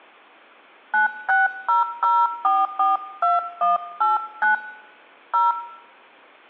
DTMF, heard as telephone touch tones, dialled by hand, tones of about 190 ms. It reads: 9600442189 0